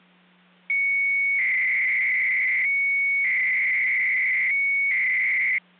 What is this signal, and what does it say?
300-baud modem data (Bell 103 tones), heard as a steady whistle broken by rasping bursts, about 300 baud, 200 Hz shift, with hum.